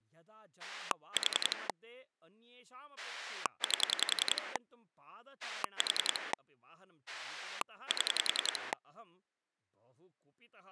Pulse dialling, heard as a rotary dial, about 10 pulses a second, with speech in Sanskrit. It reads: 4 8 4 7